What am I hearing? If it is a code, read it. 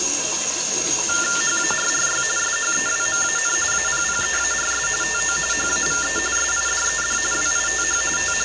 TTY/TDD text telephone tones (45.45 baud Baudot), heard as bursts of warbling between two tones, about 400 Hz shift, 1600 Hz centre, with room echo and the noise of a restroom. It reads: HARRY SHEWMAN APPEARS TO HAVE SIDED WITH …